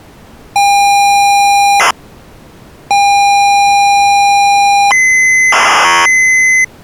ZX Spectrum tape loading, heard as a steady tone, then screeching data.